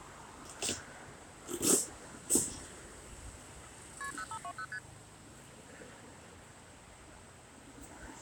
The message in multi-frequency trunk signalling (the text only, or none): KP 0520 ST